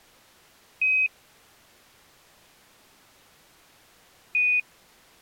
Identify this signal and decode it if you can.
Quindar tones, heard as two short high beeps.